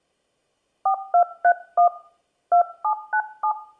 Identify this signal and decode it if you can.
DTMF, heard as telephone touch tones, dialled by hand, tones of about 90 ms. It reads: 4231 2797